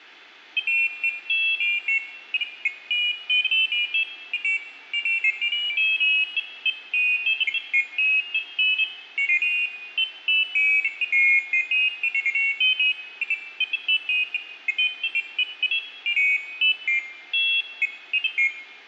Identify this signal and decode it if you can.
Pairs of high tones at irregular times, with room echo. There is no code.